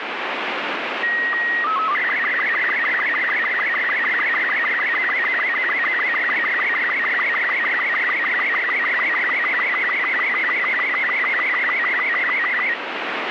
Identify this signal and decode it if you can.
SSTV (slow-scan television), Robot 36, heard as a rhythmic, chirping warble, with radio static.